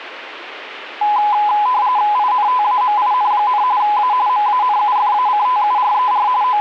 RTTY (45.45 baud, 170 Hz shift), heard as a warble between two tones, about 920 Hz centre, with radio static. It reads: INTAMIN, A MANUFACTURER …